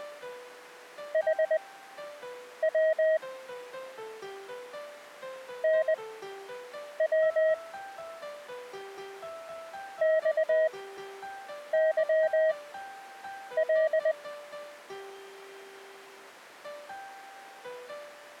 Morse code, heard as a keyed tone, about 20 wpm, spaced as for 7 wpm, 630 Hz. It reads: HW NW XYL